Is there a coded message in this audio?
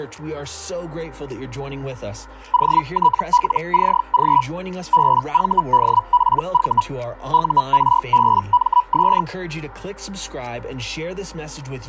Yes: Hellschreiber (Feld-Hell, 122.5 baud) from 2.5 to 9.2 s, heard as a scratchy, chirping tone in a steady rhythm, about 980 Hz. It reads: OTLCG BVDPV URBMS